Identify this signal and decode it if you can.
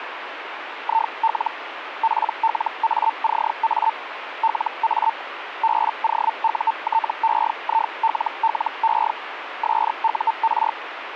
Hellschreiber (Feld-Hell, 122.5 baud), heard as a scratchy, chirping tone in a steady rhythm, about 900 Hz, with radio static. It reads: IL PLACA LA BOUTEILLE SUR